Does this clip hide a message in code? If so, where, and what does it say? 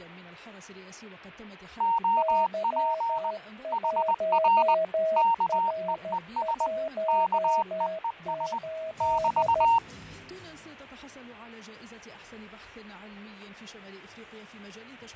Yes: Morse code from 1.7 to 9.8 s, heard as two keyed tones, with fading. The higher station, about 20 wpm, 920 Hz: OP HR KEES KEES <BT>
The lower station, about 13 wpm, 640 Hz: Y1R18